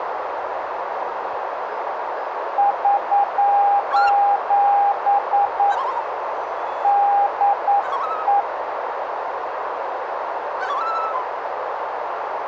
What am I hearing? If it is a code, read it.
Morse code, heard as a keyed tone, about 9 wpm, 810 Hz, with radio static and a narrow filter. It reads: <SOS> DE